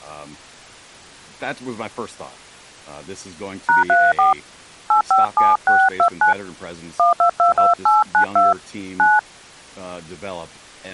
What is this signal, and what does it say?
DTMF, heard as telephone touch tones, dialled by hand, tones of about 150 ms, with speech in English. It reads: #34 857629 1222892 9